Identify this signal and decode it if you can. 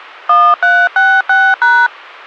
DTMF, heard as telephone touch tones, dialled by hand, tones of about 250 ms. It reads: 1366#